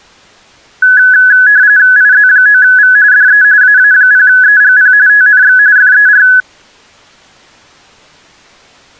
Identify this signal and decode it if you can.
RTTY (45.45 baud, 170 Hz shift), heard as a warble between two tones, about 1600 Hz centre. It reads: IZ9V DE AA0EGP TNX FER